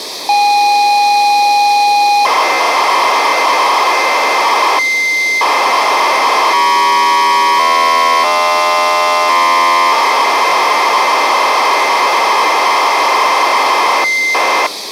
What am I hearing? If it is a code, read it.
ZX Spectrum tape loading, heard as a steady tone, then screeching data, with tape hiss.